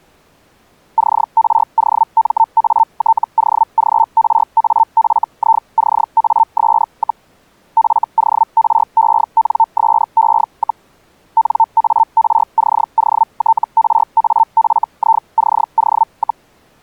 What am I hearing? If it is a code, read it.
Hellschreiber (Feld-Hell, 122.5 baud), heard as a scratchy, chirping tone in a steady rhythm, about 900 Hz. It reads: CROMATOGRAFICAS, FORENSE, NARCOTRAFICO,